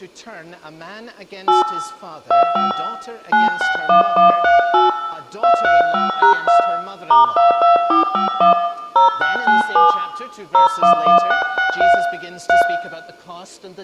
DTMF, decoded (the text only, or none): 8 25 961138 235#2 *22451 0697 011663 3